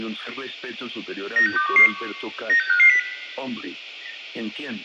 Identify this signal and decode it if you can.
Five-tone selective call (CCIR), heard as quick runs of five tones, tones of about 100 ms, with room echo. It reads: 96211 96550